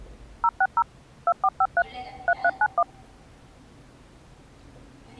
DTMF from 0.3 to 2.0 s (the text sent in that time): 060 2453